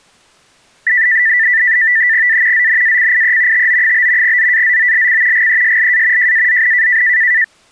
NAVTEX (SITOR-B), 100 baud, 170 Hz shift, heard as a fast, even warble, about 1900 Hz centre. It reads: A ZNACIE TO? ZAZOLC GESLA JAZN